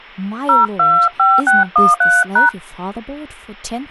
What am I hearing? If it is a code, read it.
DTMF, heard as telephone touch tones, dialled by hand, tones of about 200 ms, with speech in English. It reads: 025613#